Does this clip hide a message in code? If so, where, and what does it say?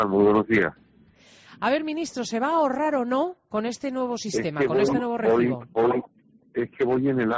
No.